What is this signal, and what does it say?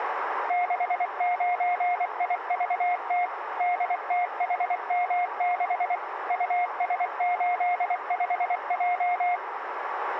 Morse code, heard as a keyed tone, machine-sent, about 24 wpm, 710 Hz, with radio static and a narrow filter. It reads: 69IVT DTHM6 US85J